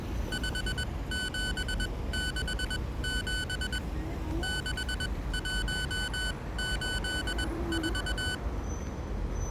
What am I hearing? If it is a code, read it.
Morse code, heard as electronic beeps, machine-sent, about 21 wpm, spaced as for 17 wpm, 1500 Hz, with street noise. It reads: 5767 6184